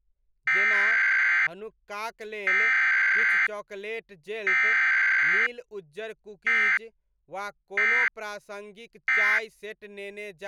Emergency Alert System (SAME) tones (header bursts, then end-of-message bursts), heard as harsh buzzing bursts, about 520.83 baud, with speech in Maithili.